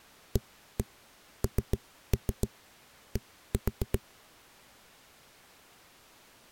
Tap code, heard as knocks on a wall, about 7 knocks a second. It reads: AND